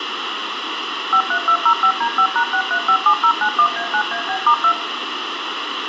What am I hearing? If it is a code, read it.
DTMF, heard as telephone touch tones, dialled by machine, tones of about 80 ms, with radio hiss and room echo. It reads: 53205D5#6357091A9AB*2